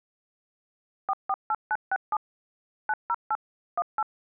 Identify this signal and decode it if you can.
DTMF, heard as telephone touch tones, dialled by machine, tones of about 50 ms. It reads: 448967 908 18